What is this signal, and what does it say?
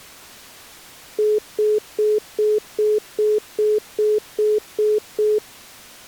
Telephone call progress tone (single-tone plan, as in most of Europe), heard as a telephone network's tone, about 420 Hz, 0.2 s on and 0.2 s off. Congestion tone.